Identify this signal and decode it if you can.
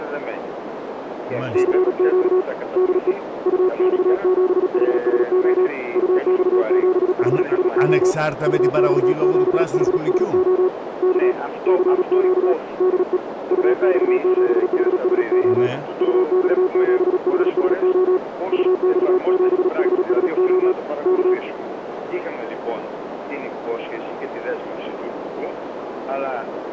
Morse code, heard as a keyed tone, hand-sent with a paddle, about 37 wpm, 370 Hz, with radio static and a narrow filter. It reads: CQ DE UX7HSO UX7HSO UX7HSO K CQ DE UX7HSO UX7HSO UX7HSO K